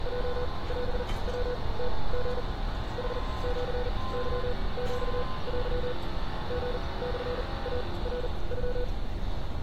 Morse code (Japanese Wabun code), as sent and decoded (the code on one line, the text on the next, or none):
.--- .-... .-- - --. / .... --.-. -.-- --..- .-.-- / --. -..-. .- .-. ..--
ヲオヤムリ ヌシケヒテ リモイナノ